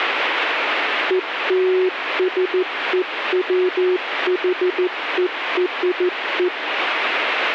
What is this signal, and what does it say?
Morse code (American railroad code), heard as a keyed tone, machine-sent, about 370 Hz, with radio static. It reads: ELSEWHERE